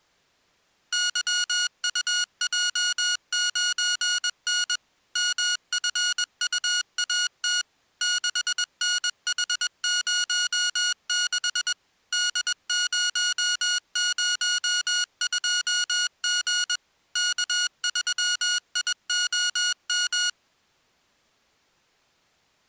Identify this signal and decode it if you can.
Morse code, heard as electronic beeps, machine-sent, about 21 wpm, 1450 Hz. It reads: YUJ9N MFUAT 6NH06 D002G K3IOM